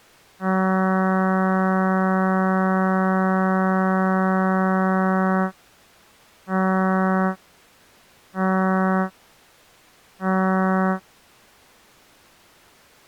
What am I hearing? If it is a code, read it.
Ship horn signal, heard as a ship's horn, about 190 Hz. 1 long, 3 short. At sea: a vessel under tow in fog.